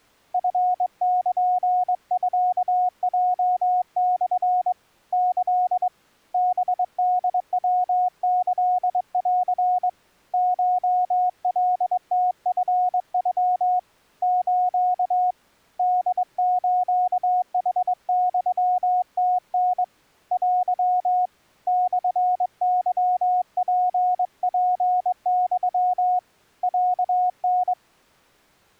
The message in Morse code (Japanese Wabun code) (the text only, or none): チルミヲモ キ ハホヤキン コカムチノ ス ホスヌユムタ テ モケツツユ ロタ